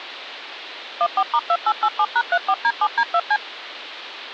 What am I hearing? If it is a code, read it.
DTMF, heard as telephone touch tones, dialled by machine, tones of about 60 ms. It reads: 14*2887#34D7D2C